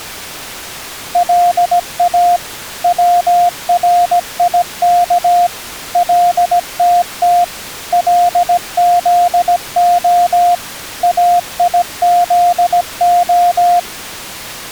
Morse code (Hebrew alphabet), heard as a keyed tone, machine-sent, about 17 wpm, 700 Hz. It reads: לא צריך לתת לזה איזה